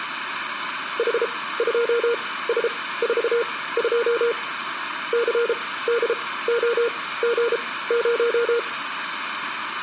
Morse code, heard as a keyed tone, machine-sent, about 33 wpm, spaced as for 18 wpm, 470 Hz, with room echo. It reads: H2S42 CDOG0